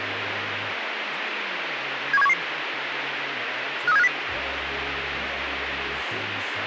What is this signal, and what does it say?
Five-tone selective call (EEA), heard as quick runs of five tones, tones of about 40 ms, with radio hiss. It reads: 71711 53750